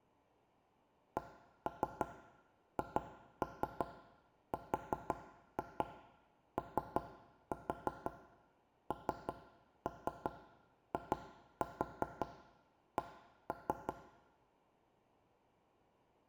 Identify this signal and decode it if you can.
Tap code, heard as knocks on wood, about 5 knocks a second, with room echo. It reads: CHRONIC